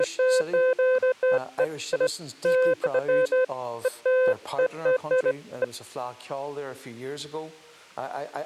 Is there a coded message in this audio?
No, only beeps of irregular length.